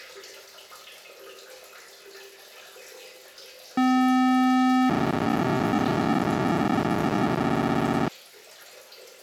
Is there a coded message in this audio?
Yes: POCSAG pager data (512 baud) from 3.8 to 8.1 s, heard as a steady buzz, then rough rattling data, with the noise of a restroom.